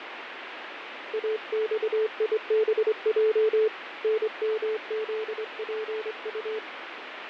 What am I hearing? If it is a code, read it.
Morse code, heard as a keyed tone, hand-sent with a straight key, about 25 wpm, 440 Hz, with radio static and fading. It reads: AXIBJ NMZPU